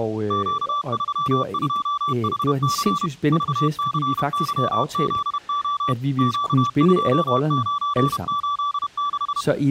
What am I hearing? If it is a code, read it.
Morse code, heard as a keyed tone, machine-sent, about 31 wpm, 1160 Hz, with speech in Danish. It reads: Q32HC VCYZO Q2986